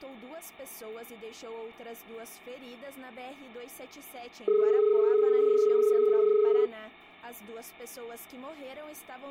Telephone call progress tone (as in Australia), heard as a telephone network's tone, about 430 Hz. Dial tone.